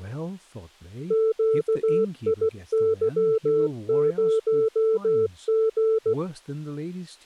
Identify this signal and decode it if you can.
Morse code, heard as a keyed tone, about 16 wpm, 440 Hz, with speech in English. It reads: QIY0G